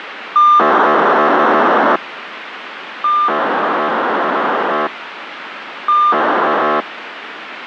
POCSAG pager data (2400 baud), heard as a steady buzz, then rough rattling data, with radio hiss.